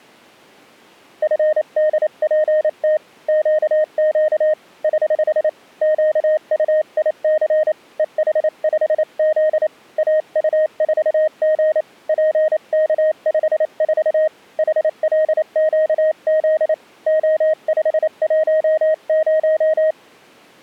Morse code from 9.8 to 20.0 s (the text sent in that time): AU4G PK54 HLQZ O510